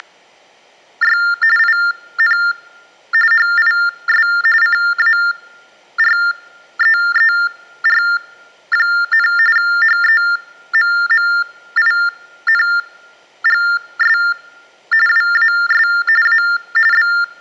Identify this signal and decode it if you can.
TTY/TDD text telephone tones (45.45 baud Baudot), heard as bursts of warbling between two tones, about 400 Hz shift, 1600 Hz centre. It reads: … IN HIS CAREER, HEMMINGS WAS A …